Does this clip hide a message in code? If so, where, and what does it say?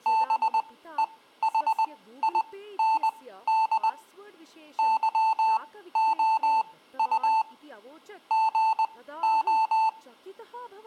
Yes: Morse code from 0.0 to 10.0 s, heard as electronic beeps, machine-sent, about 20 wpm, spaced as for 14 wpm, 890 Hz, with speech in Sanskrit. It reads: BEHIND YOU GO